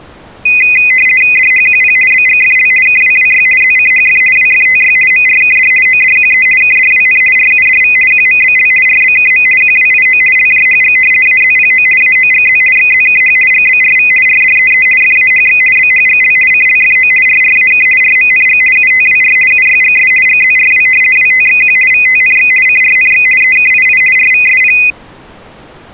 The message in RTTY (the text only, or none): DHQP BGFL KWWY ZCHF WFTY MRKD ODQE KDWN RUDV QMBL RBKM QWIO LJHG AZPO AOGZ XZKH GBRV RDEE FAHX BHGL CLFO RRAK RMNG UTWR UYGS GZRW WTXQ VTNX CRNX EKII RVSP